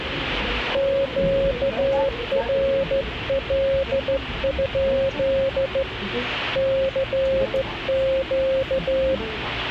Morse code, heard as a keyed tone, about 14 wpm, 540 Hz, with radio static and the noise inside a subway train. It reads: QRL? CQ